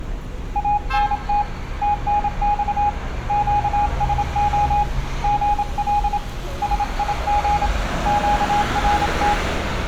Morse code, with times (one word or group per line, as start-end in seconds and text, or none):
0.6-1.4 ANT
1.8-2.9 TNX
3.3-4.8 QSO
5.2-6.2 GL
6.6-7.7 SIG
8.1-9.3 QRT